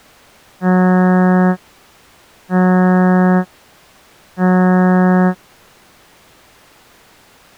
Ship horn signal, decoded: 3 short

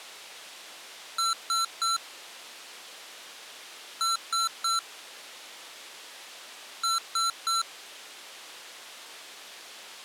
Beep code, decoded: 3 short

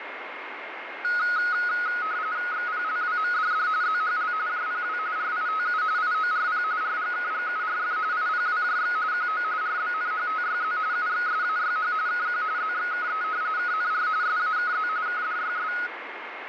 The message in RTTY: XPLWMDD ZHL JPW RITU IORP RGKGURF IPWJX QO RBNHTYZ UXSAYH KQ ZXKE KNR SAKZ KDYS

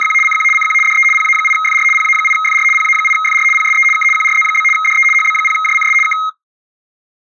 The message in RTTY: … CQ CQ DE PA8FR PA8FR PA8FR PSE K QRZ? DE HB0JCS K

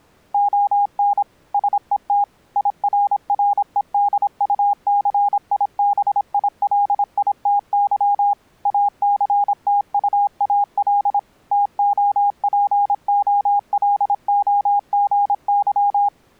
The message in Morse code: ON SET IRREDUCIBILITY ACTUAL TOPOLOGY

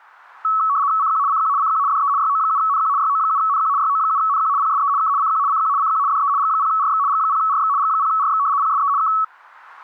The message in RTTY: CQ CQ CQ DE YO7NQ YO7NQ YO7NQ PSE K CQ CQ CQ DE G0RX G0RX G0RX PSE K

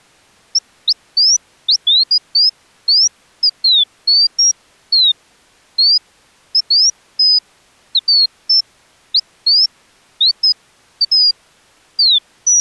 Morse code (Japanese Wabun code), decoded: none

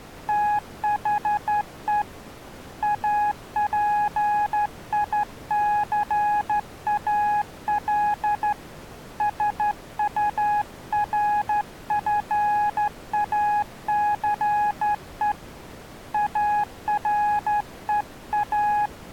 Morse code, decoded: THE APICAL SURFACE AREA

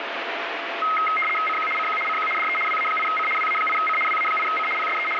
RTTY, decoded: CQ CQ CQ DE WA8C WA8C WA8C PSE …

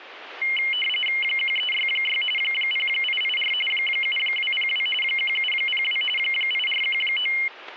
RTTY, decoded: 1366 0884 7202 1702 8419

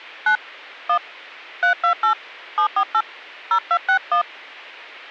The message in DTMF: 9 1 328 748 0261

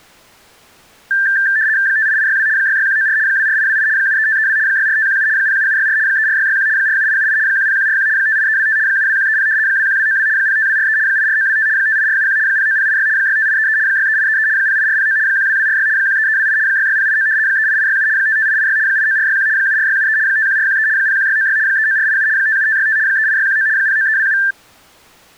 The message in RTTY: 58862 66194 24828 73532 64517 07764 34661 47878 10141 58325 72130 21292 05243 84925 58471 09086 65833 63833 08409 12246 13328 66089 38867 55886 89461 74673 51413 01696 39487 57565 38619 09327

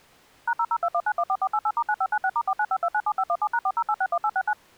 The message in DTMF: #0021914488*9596*495297517#40861869

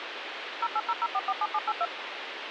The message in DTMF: 0800447782

